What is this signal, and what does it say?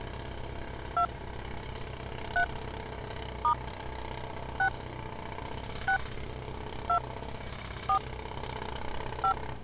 DTMF, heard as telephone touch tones, dialled by hand, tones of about 90 ms, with street noise. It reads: 2 3 * 6 6 2 4 5